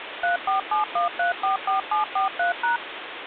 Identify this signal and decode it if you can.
DTMF, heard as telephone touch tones, dialled by machine, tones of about 130 ms, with phone line noise. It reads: 3471344743#